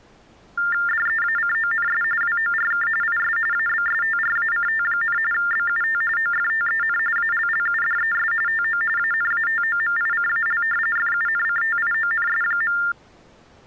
TTY/TDD text telephone tones (45.45 baud Baudot), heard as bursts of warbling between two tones, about 400 Hz shift, 1600 Hz centre. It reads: DEACONS WORK IS ABSTRACT, BUT OFTEN ALLUDES TO ANATOMICAL FUNCTIONS.